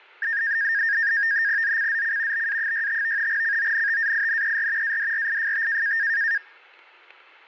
NAVTEX (SITOR-B), 100 baud, 170 Hz shift, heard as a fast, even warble, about 1750 Hz centre, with static crashes. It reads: ZCZC BA65 CONTAINER ADRIFT